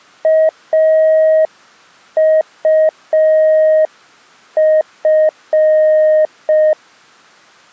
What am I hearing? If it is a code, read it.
Morse code, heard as a keyed tone, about 5 wpm, 630 Hz. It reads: AUF